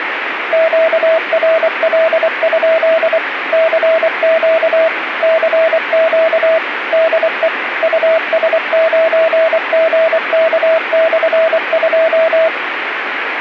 Morse code, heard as a keyed tone, machine-sent, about 24 wpm, 650 Hz, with radio static. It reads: QRL? CQ CQ DE US9GK/2